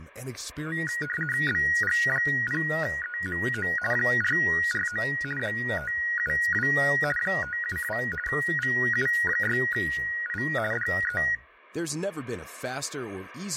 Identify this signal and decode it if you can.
RTTY (50 baud, 450 Hz shift), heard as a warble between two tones, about 1700 Hz centre, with speech in Swedish. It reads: BG0EMO 449 572 572 VU6I DE